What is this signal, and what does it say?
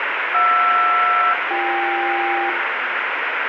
Aircraft SELCAL, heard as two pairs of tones, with radio static. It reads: JR-BK